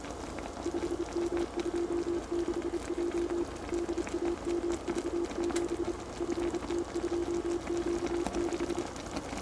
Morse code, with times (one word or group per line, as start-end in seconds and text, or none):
0.7-3.4 5M26J
3.7-5.9 DAMV7
6.2-8.8 FT2Q6